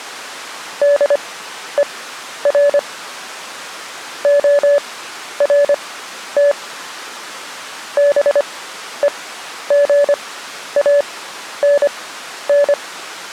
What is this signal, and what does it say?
Morse code, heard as a keyed tone, machine-sent, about 25 wpm, spaced as for 11 wpm, 570 Hz. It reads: DER ORT BEGANN